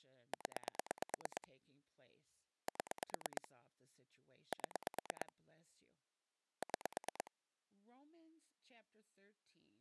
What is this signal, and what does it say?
Pulse dialling, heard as clicks on a phone line, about 9 pulses a second, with speech in English. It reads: 0 7 7 6